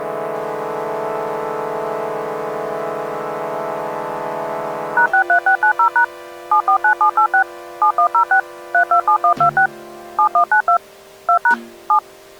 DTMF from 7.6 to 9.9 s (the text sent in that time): 7106 327126